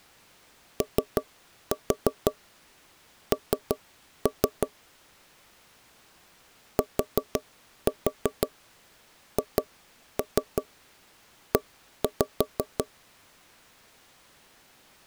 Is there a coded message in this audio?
Yes: tap code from 0.8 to 12.9 s, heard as knocks on wood, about 5 knocks a second. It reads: ON THE